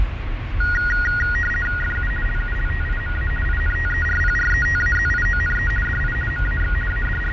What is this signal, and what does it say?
RTTY (50 baud, 450 Hz shift), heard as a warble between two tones, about 1650 Hz centre, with radio static, fading and the noise inside a car. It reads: FU LULTIMA INTERPRETAZIONE DI MAX …